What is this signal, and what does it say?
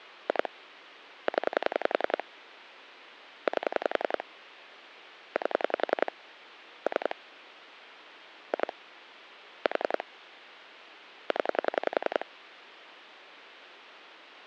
Pulse dialling, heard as clicks on a phone line, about 10 pulses a second. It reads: 2 0 8 8 3 2 4 0